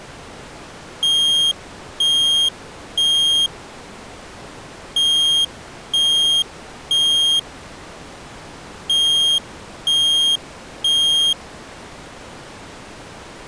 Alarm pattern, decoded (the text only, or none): temporal three